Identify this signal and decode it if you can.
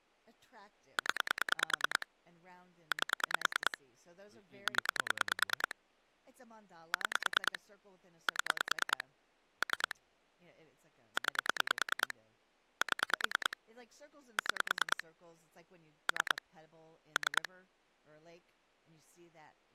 Pulse dialling, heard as clicks on a phone line, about 9 pulses a second, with speech in English. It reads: 0 8 0 6 7 3 9 7 6 3 3